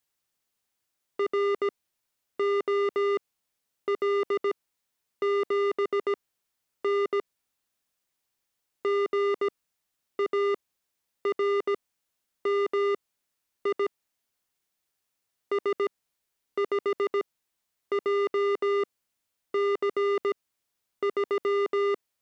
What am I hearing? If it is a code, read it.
Morse code, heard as electronic beeps, machine-sent, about 17 wpm, spaced as for 9 wpm, 400 Hz. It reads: ROL7N GARMI S5JC3